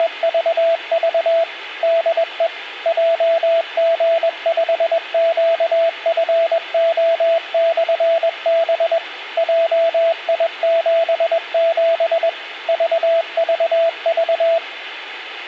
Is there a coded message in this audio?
Yes: Morse code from 0.0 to 14.6 s, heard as a keyed tone, machine-sent, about 21 wpm, 660 Hz, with a squelch burst at the end. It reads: … DE JG5QFO/B JI77 VVV